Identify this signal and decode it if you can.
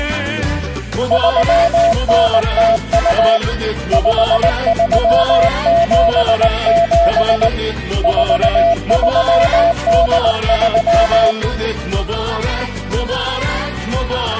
Morse code (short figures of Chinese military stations), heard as a keyed tone, hand-sent with a paddle, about 19 wpm, 680 Hz. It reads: 3902 5377 4383